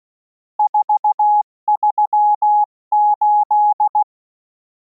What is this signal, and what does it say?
Morse code, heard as a keyed tone, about 16 wpm, 840 Hz. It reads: 438